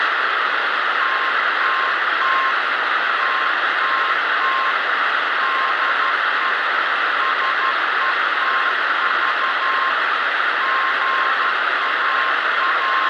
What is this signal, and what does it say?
Morse code, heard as a keyed tone, machine-sent, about 12 wpm, 1070 Hz, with heavy radio static. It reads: TTT TTT DE SETV …